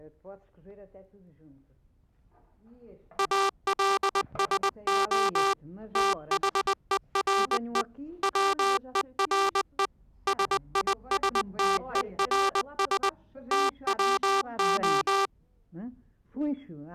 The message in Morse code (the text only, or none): ALSO THERE WERE SISTERS TWO